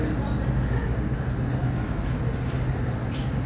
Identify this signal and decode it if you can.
The noise of a cafe. There is no code.